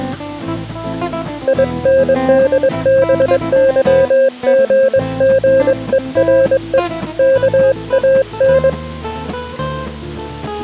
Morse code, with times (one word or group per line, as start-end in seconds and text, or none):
1.5-6.8 INDBYGGERE
7.2-8.7 KAN